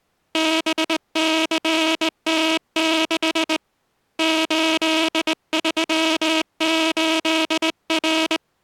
Morse code, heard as a buzzer, hand-sent with a straight key, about 19 wpm. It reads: BCT6 838R